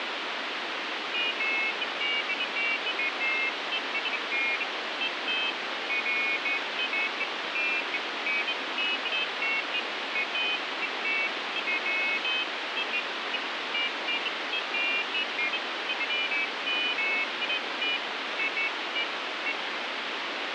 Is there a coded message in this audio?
No, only pairs of high tones at irregular times, with heavy radio static.